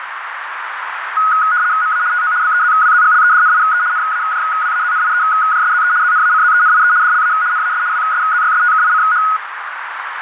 RTTY (75 baud, 170 Hz shift), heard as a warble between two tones, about 1360 Hz centre, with radio static and a narrow filter. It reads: MA TO BEZWZGLEDNIE NAJWAZNIEJSZE ZNACZENIE DLA NAS WSZYSTKICH